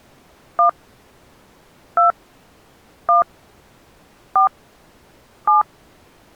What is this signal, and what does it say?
DTMF, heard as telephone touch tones, dialled by hand, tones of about 130 ms. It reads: 1 2 1 4 7